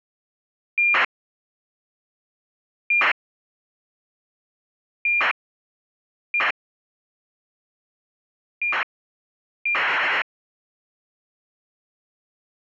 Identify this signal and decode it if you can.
ACARS aircraft data, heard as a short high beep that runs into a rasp, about 2400 baud.